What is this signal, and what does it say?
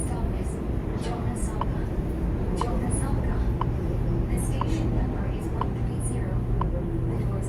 Radio time signal (WWV, Colorado), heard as ticks, one a second, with the noise inside a subway train.